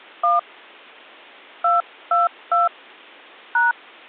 DTMF, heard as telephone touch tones, dialled by hand, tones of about 160 ms. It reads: 1 222 #